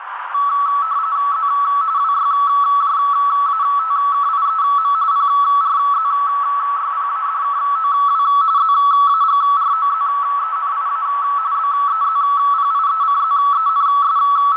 RTTY (45.45 baud, 170 Hz shift), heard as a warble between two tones, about 1220 Hz centre, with radio static, a narrow filter and room echo. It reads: Z WYJATKIEM PRZYPADKOW ZAGROZENIA …